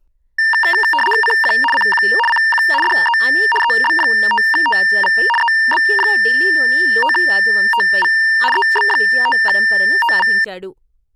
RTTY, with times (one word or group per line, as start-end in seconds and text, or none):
1.2-1.5 CQ
1.7-2.0 CQ
2.3-2.6 CQ
2.8-3.2 DE
3.6-5.1 EB5TV
5.4-8.1 EB5TV
8.5-10.3 EB5TV